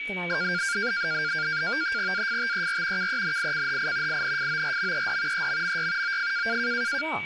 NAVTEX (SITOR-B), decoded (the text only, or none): AFTER KENICHI INFORMED EMMY OF